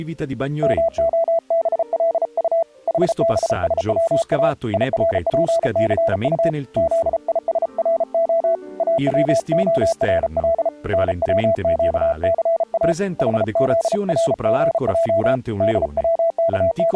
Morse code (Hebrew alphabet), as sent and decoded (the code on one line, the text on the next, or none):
-- --- -... .-.. ..- / .... -... ... .-- .- / .. .-. .--. -.-. ..- / --.. .. ... .-. --- / .- .-- --- .-. .-.. / -. .-- --.- -.-. .- / .... --.. .-. --. .--- / …
מהבלט חבשצא ירפסט זישרה אצהרל נצקסא חזרגע …